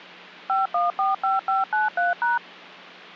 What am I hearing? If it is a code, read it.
DTMF, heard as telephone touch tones, dialled by machine, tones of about 160 ms. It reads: 5145593#